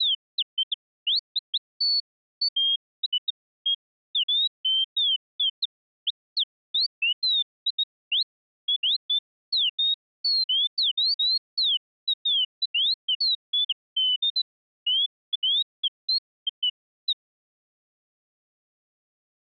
Bird-like chirps. There is no code.